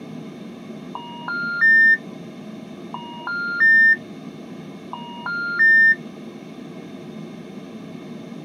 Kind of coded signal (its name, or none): telephone call progress tone